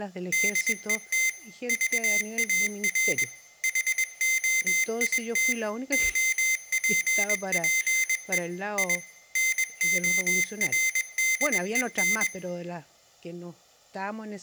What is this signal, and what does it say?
Morse code, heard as a high beeper, machine-sent, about 21 wpm, 2100 Hz, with room echo and speech in Spanish. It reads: DET VAR HOIT OPPE I NORDEN